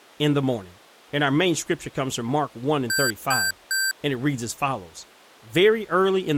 Beep code, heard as beeps from a small speaker, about 1550 Hz, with speech in English. 3 short. In AMI BIOS tables: failure in the first 64 KB of memory; in Dell tables: chipset error.